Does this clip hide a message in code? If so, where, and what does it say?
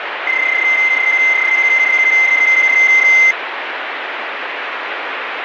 Yes: PSK31 (31.25 baud) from 0.3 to 3.3 s, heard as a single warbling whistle, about 2050 Hz, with radio static.